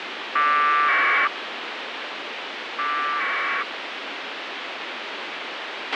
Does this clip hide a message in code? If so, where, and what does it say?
Yes: packet radio (AX.25, as in APRS), 1200 baud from 0.4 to 3.6 s, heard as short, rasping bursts, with radio hiss and a squelch burst at the end.